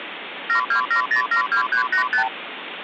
Multi-frequency trunk signalling (R2, with the far end's replies), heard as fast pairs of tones, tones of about 100 ms, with phone line noise. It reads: 727072385